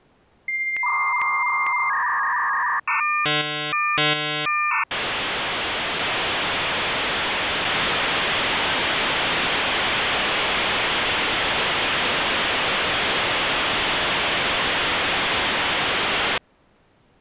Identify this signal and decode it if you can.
Dial-up modem handshake (V.34 or later), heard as a whistle, warbles, then hiss.